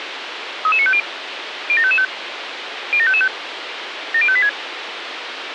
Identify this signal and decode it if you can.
Five-tone selective call (ZVEI), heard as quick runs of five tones, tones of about 70 ms, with radio hiss. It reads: 33950 07555 07555 70586